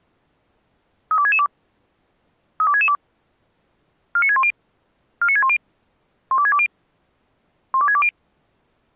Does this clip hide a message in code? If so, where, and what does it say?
Yes: five-tone selective call (ZVEI) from 1.1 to 8.1 s, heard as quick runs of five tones, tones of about 70 ms. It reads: 32662 32662 49610 49610 12620 12620